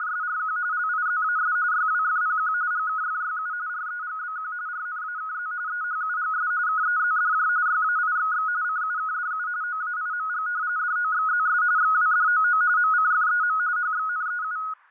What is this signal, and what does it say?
RTTY (45.45 baud, 170 Hz shift), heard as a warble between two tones, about 1360 Hz centre, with fading. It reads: … LIZAS YWFPQ GKFYU REGBQ RNAKZ EHUGS KEZDJ YAIXX CUKDU OAIMG DOXZS XWDOO MCFEM HXNEU